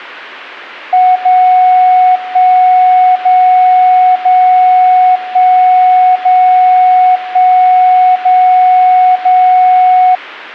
Radio time signal (DCF77), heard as a tone whose level steps once a second, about 740 Hz. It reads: 0 1 0 0 1 0 1 0 0